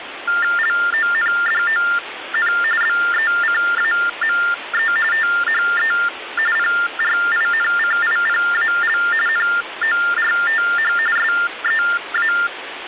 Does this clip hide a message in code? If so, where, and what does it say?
Yes: TTY/TDD text telephone tones (45.45 baud Baudot) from 0.3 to 12.5 s, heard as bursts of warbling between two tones, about 400 Hz shift, 1600 Hz centre, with phone line noise. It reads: LONDON BECAME THE PRINCIPAL NORTH SEA